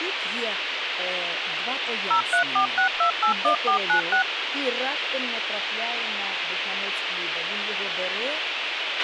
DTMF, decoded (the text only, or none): 0346281496